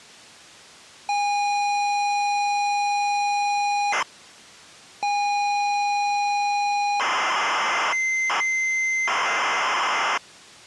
ZX Spectrum tape loading, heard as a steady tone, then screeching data.